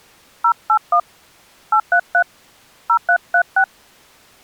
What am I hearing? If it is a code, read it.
DTMF, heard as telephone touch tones, dialled by hand, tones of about 80 ms. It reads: 081 833 0336